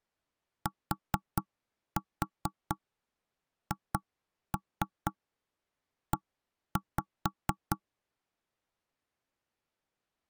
Tap code, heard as knocks on wood, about 4 knocks a second. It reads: THE